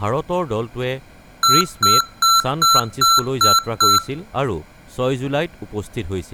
Beep code, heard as beeps from a small speaker, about 1350 Hz, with speech in Assamese. 7 short. In AMI BIOS tables: virtual mode exception error; in Dell tables: processor failure.